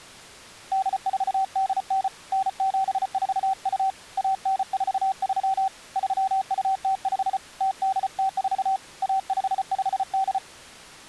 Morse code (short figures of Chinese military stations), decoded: 8489 9742 1943 3205 0804 1558

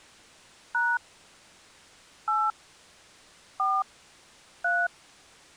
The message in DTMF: # 8 4 3

